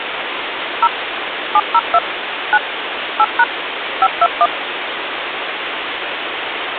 DTMF, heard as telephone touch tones, dialled by machine, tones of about 50 ms, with phone line noise. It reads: 0 702 9 8# 521